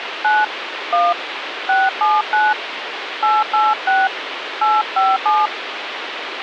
DTMF, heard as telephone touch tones, dialled by hand, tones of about 200 ms, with phone line noise. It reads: 9 1 679 886 857